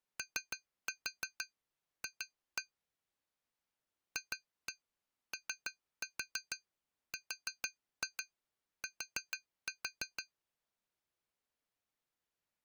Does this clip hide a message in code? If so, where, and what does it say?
Yes: tap code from 0.2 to 10.3 s, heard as taps on glass, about 6 knocks a second. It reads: OF FORT